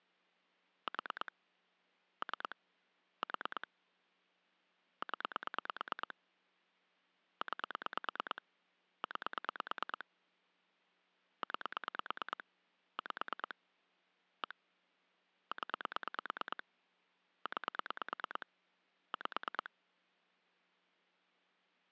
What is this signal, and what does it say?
Pulse dialling, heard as clicks on a phone line, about 9 pulses a second. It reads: 4 3 4 0 9 9 9 5 1 0 9 5